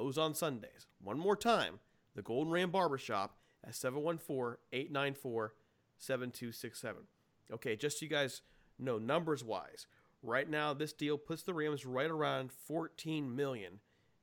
Speech in English. There is no code.